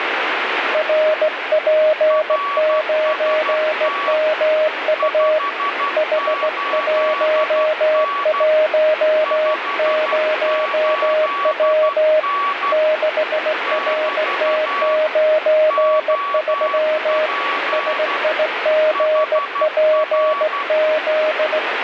Morse code, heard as two keyed tones, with heavy radio static. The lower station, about 17 wpm, 620 Hz: RP9MU H110W 6RT93 SIGPZ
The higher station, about 12 wpm, 1140 Hz: RST 58N 58N <BT> OP HR